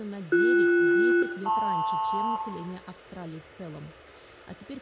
Aircraft SELCAL, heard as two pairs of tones, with room echo. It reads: BS-LP